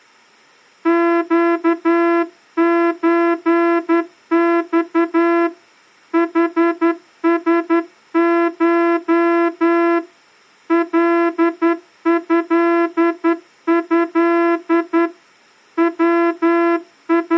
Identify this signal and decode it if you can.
Morse code (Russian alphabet), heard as a horn, hand-sent with a straight key, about 11 wpm. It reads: ЩЧЬ ХСШ ЛЭЭ …